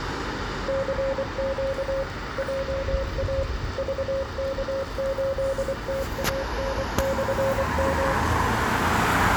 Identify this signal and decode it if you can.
Morse code, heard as a keyed tone, machine-sent, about 24 wpm, 540 Hz, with radio static, room echo and street noise. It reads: CQ JA VK8TAN/M